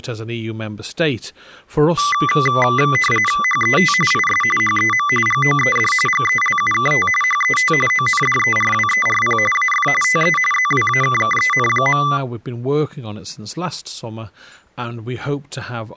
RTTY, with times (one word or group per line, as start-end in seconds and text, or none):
3.4-3.9 HET
4.1-4.4 IS
4.6-5.1 HEM
5.3-5.9 GOED
6.1-7.1 GELUKT
7.2-7.7 HET
7.9-9.4 ONDERWERP
9.5-9.9 AF
10.0-10.4 TE
10.5-12.0 ZWAKKEN.